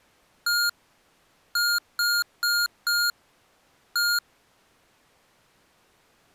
Beep code, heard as beeps from a small speaker, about 1420 Hz. 1-4-1. In Phoenix BIOS tables: address line failure in the first 64 KB of memory.